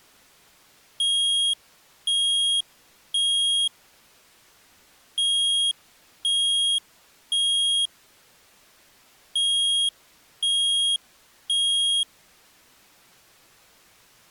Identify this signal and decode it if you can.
Alarm pattern, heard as an alarm's beeps, played three times, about 3250 Hz. Temporal three. Smoke or fire, evacuate.